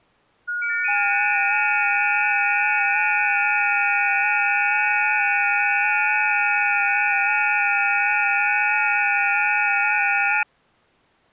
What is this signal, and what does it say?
FT8 (several signals at once), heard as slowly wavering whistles, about 6.25 baud.